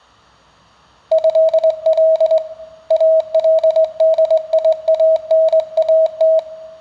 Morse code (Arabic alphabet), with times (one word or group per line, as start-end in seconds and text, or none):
1.1-2.4 هل
2.9-6.4 الديانات